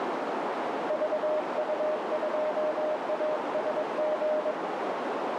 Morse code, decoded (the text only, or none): VU2ASG